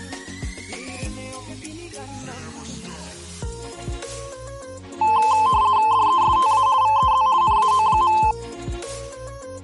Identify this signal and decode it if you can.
RTTY (50 baud, 170 Hz shift), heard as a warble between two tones, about 960 Hz centre. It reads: DESTA VEZ NAO.